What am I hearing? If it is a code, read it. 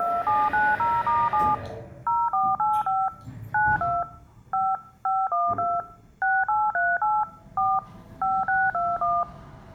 DTMF, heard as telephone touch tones, dialled by machine, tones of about 220 ms, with the noise inside a lift. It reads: 2790*7 0485 92 5 512 6838 4 5621